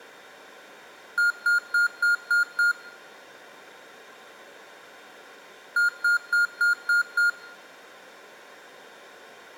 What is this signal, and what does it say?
Beep code, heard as beeps from a small speaker, played twice, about 1420 Hz, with room echo. 6 short. In AMI BIOS tables: keyboard controller gate A20 failure; in Dell tables: video card failure.